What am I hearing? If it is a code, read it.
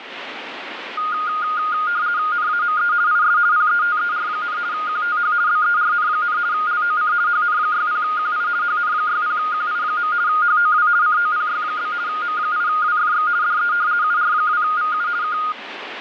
RTTY (50 baud, 170 Hz shift), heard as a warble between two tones, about 1330 Hz centre, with radio static. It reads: NAME IS PETER, QTH BERN, LOC HN60QI HN60QI. HOW COPY? M8WFX DE UR2VU K